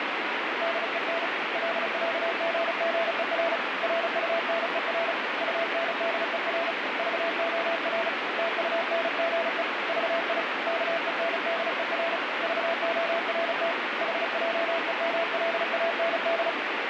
Morse code (with Danish letters), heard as a keyed tone, hand-sent with a paddle, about 35 wpm, 670 Hz, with heavy radio static. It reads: DEN LÆGGER RUNER UNDER VOR TUNGE VI KENDER VORT HJEMLAND